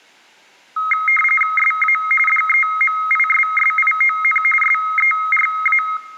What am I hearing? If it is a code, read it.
RTTY (45.45 baud, 850 Hz shift), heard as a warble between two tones, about 1700 Hz centre. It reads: SA DEMISSION SERA